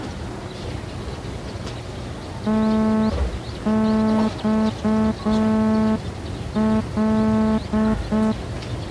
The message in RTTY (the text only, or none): none